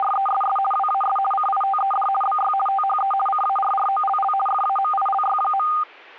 RTTY (50 baud, 450 Hz shift), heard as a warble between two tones, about 1010 Hz centre. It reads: … WAS CITED BY THE CARROLL FAMILY.